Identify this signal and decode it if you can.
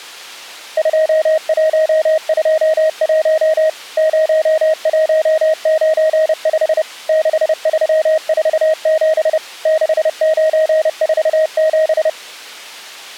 Morse code, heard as a keyed tone, machine-sent, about 30 wpm, 630 Hz. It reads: 2121 0195 6347 6947